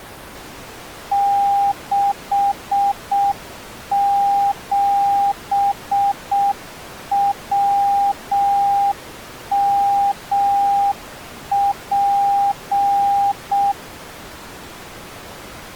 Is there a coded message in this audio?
Yes: Morse code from 1.1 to 13.8 s, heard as a keyed tone, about 6 wpm, 800 Hz. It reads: 67WMP